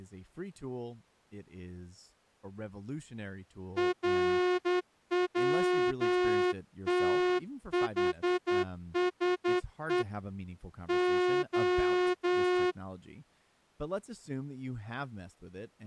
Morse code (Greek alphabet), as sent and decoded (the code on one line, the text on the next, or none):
.-. .-- - .... ... . / ---
ΡΩΤΗΣΕ Ο